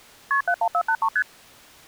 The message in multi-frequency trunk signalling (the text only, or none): KP 71483 ST